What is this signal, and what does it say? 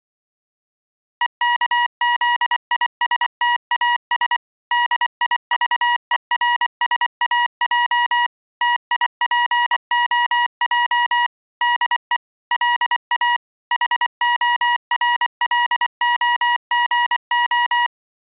Morse code, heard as electronic beeps, machine-sent, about 24 wpm, 960 Hz. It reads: EKZISTAS DIVERSAJ TIPOJ DE LA HORLOGO